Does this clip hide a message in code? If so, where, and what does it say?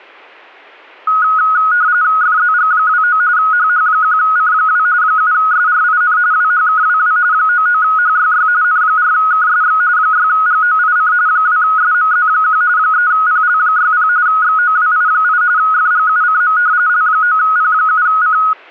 Yes: RTTY (45.45 baud, 170 Hz shift) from 1.1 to 18.5 s, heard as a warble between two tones, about 1360 Hz centre. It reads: FZG29 HH1C2 7SRIN WHKWW 99HYY N4KSX 6GOIC 2SMZ1 3PL60 XOWI8 FGUCM L9P7C